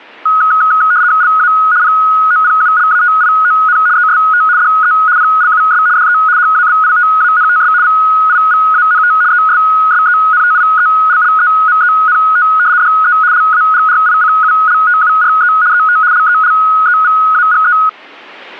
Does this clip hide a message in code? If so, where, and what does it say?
Yes: RTTY (75 baud, 170 Hz shift) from 0.3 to 17.9 s, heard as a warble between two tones, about 1360 Hz centre. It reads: LA POPULATION EST DE PLUS DE HABITANTS VIVANT ESSENTIELLEMENT DE LAGRICULTURE ET LELEVAGE